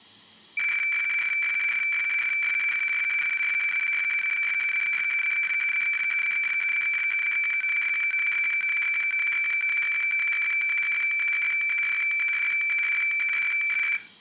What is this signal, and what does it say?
Weather fax (radiofax), 120 lines a minute, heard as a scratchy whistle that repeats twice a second, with room echo.